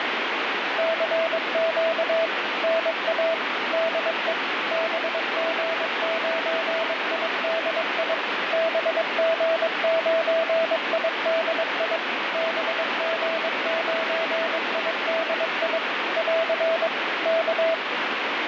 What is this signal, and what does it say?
Morse code, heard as a keyed tone, machine-sent, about 22 wpm, 660 Hz, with heavy radio static. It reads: CQ NA DE BG9IDI BG9IDI BG9IDI <AR> K